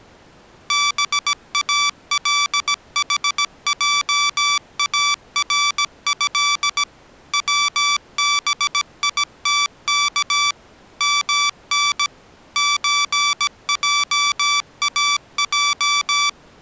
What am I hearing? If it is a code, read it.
Morse code (Arabic alphabet), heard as electronic beeps, machine-sent, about 17 wpm, 1160 Hz. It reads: بالحجاره وبيتك من زجاج